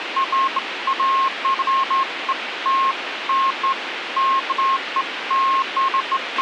Beeps of irregular length, with radio hiss and a squelch burst at the end. There is no code.